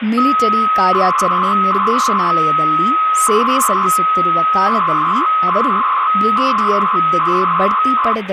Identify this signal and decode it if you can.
300-baud modem data (Bell 103 tones), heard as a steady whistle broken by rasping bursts, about 300 baud, 200 Hz shift, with phone line noise and speech in Kannada.